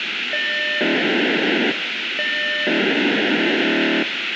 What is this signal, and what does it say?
POCSAG pager data (1200 baud), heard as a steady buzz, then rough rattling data, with radio hiss.